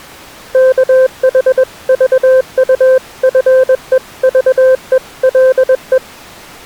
Morse code (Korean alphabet), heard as a keyed tone, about 21 wpm, 520 Hz. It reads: 우리나라가